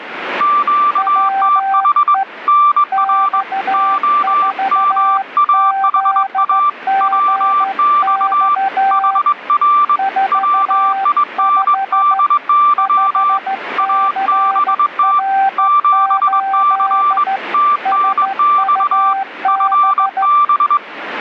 Morse code, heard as two keyed tones, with radio static. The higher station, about 21 wpm, 1170 Hz: QTH NR OMAHA WX HR WINDY ABT 7C TNX FB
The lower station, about 14 wpm, 780 Hz: WE X4ZGX 45 5CR8 SUB